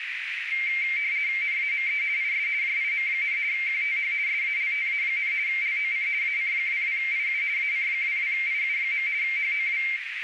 RTTY (50 baud, 170 Hz shift), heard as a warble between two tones, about 2200 Hz centre, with radio static and a narrow filter. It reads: NAME IS JIM, QTH SALTA, LOC AC22IU AC22IU. HOW